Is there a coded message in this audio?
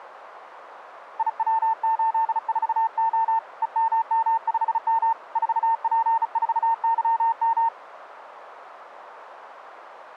Yes: Morse code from 1.1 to 7.7 s, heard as a keyed tone, hand-sent with a bug key, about 35 wpm, 900 Hz, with radio static. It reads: IW84O EMM5M 4P4YM